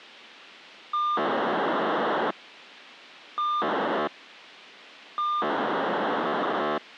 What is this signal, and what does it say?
POCSAG pager data (2400 baud), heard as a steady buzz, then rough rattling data, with radio hiss.